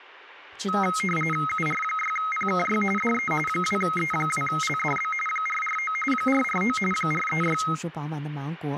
RTTY (45.45 baud, 850 Hz shift), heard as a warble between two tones, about 1700 Hz centre, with speech in Chinese. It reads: UR6PKY DE 2E2LDB 449 449 436